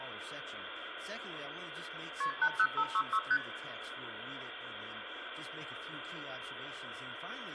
Multi-frequency trunk signalling (R1, as on North American trunks), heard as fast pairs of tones, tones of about 60 ms, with phone line noise and room echo. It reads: KP 80566 ST